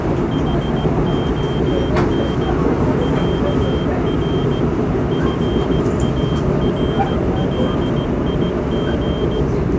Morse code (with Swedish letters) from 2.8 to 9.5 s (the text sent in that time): ÄR FARLIG